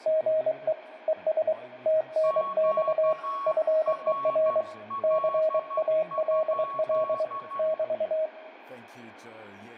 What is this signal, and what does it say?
Morse code, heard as two keyed tones, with radio static, room echo and speech in English. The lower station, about 23 wpm, 630 Hz: GE ES TNX FER CALL <BT>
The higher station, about 12 wpm, 1110 Hz: QRL?